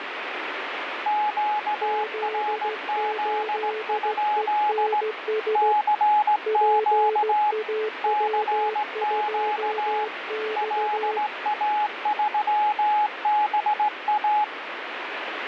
Morse code, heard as two keyed tones, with radio static. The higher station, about 17 wpm, 840 Hz: QRZ? CQ CQ LA3BA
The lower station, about 15 wpm, 430 Hz: Z8ENS PAW2X